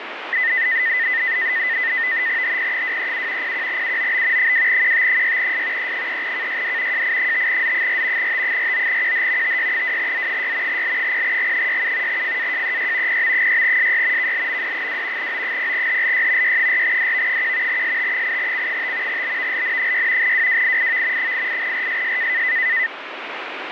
NAVTEX (SITOR-B), 100 baud, 170 Hz shift, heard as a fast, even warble, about 1900 Hz centre, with radio static. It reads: HP237 01UOB 2QT6S E3KYD JI5Z4 T49QH TY2Z6 L0G67 FAJEY PM6SY KLMD2 O0HLY Y4DV1 ST8C5 BVLN6 WWIIV 88RSS